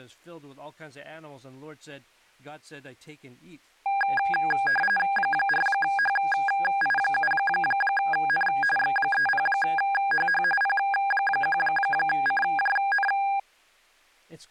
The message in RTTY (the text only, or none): 4HI7N X30HH P1CJN